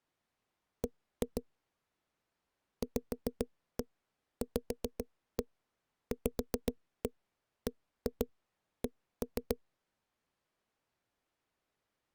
Tap code, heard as knocks on a wall, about 7 knocks a second. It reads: B VVVBC